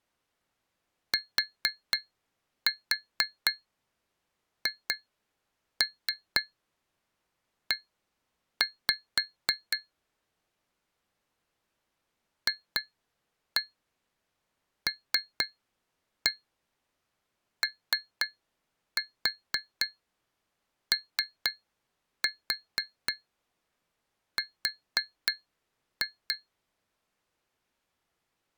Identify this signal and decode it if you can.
Tap code, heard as taps on glass, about 4 knocks a second. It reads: THE FLOOR